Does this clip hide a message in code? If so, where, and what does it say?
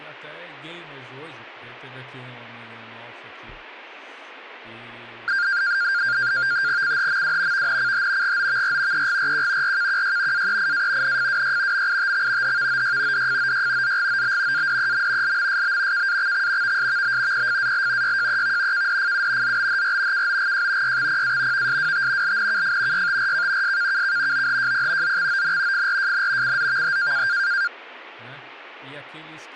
Yes: NAVTEX (SITOR-B), 100 baud, 170 Hz shift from 5.3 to 27.7 s, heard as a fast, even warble, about 1500 Hz centre, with speech in Portuguese. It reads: CHMW VNCH GOVR EGRQ RKQY AEIA NFWY MITX HVOY DFOY ZGOB ADEM LMSB KAXX VSVB PFAL YJEV KDFU ZBHR KOGJ YXPA VSWT LNKF YTRK SKKK OHJP ZXON FRJN CZVH